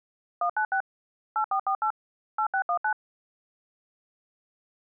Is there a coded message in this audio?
Yes: DTMF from 0.4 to 2.9 s, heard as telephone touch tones, dialled by machine, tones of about 80 ms. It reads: 196 8448 8619